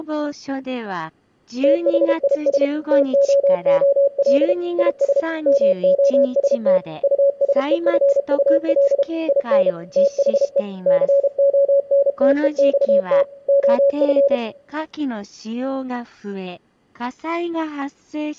Morse code, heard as a keyed tone, machine-sent, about 32 wpm, 560 Hz, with room echo. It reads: THIS TOOL IS MOST USEFUL IN THE CONTEXT OF